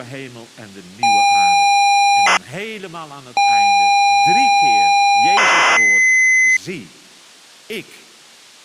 ZX Spectrum tape loading, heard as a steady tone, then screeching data, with speech in Dutch.